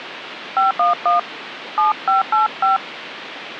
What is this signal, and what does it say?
DTMF, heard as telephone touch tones, dialled by hand, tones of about 140 ms, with phone line noise. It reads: 511 7585